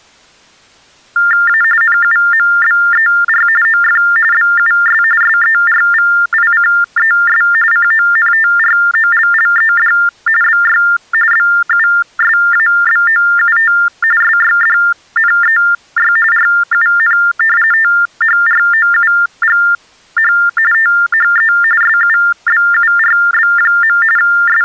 TTY/TDD text telephone tones (45.45 baud Baudot), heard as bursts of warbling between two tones, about 400 Hz shift, 1600 Hz centre. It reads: A NUMBER OF BUS SERVICES CONTROLLED BY BUSABOUT SYDNEY RUN THROUGH THE SUBURB. …